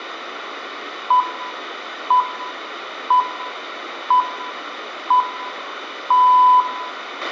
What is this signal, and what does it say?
Radio time signal (six pips, as the Greenwich Time Signal), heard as pips, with a squelch burst at the end and room echo.